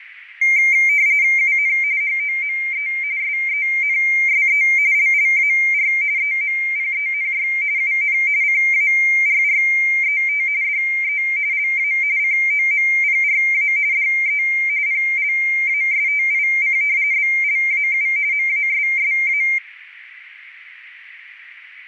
RTTY (45.45 baud, 170 Hz shift), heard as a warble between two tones, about 2200 Hz centre, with radio static, fading and a narrow filter. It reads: UN HOME SENSE LLAR EMPENY UN CARRET DE LA COMPRA DE PLASTIC BLAU MASSA